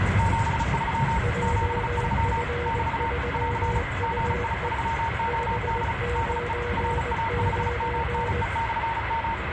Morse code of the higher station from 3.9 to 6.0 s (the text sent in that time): GI3OD